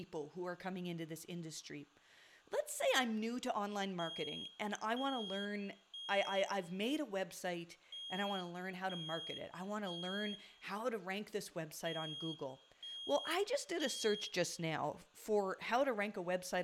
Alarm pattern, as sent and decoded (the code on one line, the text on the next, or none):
3 beeps and a pause
temporal three